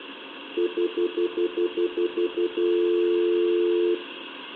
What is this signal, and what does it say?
Telephone call progress tone (North American plan), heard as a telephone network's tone, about 350, 440 Hz, 0.1 s on and 0.1 s off, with phone line noise and room echo. Stutter dial tone.